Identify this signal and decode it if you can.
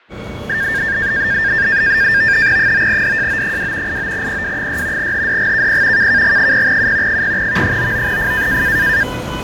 NAVTEX (SITOR-B), 100 baud, 170 Hz shift, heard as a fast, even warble, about 1700 Hz centre, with fading and the noise of a subway station. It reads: 9DJO2 89PW6 HDGKP KKG0U 0V99F